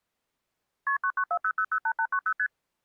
Multi-frequency trunk signalling (R1, as on North American trunks), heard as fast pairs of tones, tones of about 70 ms. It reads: KP 9940008890 ST